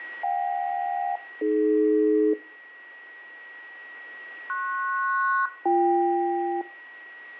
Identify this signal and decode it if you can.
Aircraft SELCAL, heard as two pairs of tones, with a steady whistle near 1910 Hz and room echo. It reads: JK-AD PS-BK